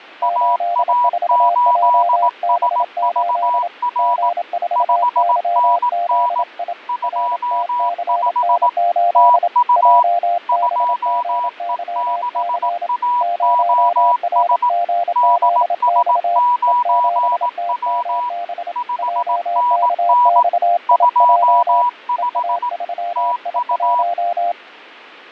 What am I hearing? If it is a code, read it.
Morse code, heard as two keyed tones, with fading. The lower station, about 27 wpm, 700 Hz: 84JB8 G4YZI RTCN8 JBGYC 0RGZX E7TMB JKXIJ EA3I1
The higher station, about 18 wpm, 980 Hz: AA8SVR 5NN 25 TU 2E6AOS DS9W 5NN 25 TU